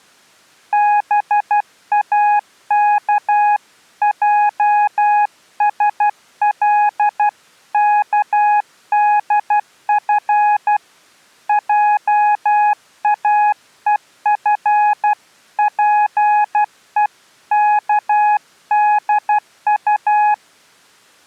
Morse code (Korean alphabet), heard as a keyed tone, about 12 wpm, 840 Hz. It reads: 동혁은 환자의